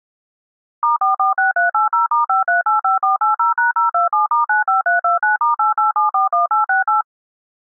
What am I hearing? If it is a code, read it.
DTMF, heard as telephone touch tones, dialled by machine, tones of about 140 ms. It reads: *446380*5385480#027*95329*88741868